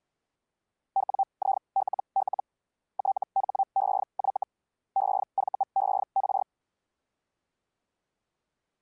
Hellschreiber (Feld-Hell, 122.5 baud), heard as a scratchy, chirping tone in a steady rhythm, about 780 Hz. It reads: WILL THEY EVER